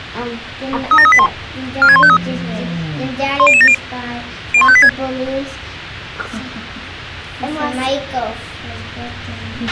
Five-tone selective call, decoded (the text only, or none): 37381 46153 10070 01586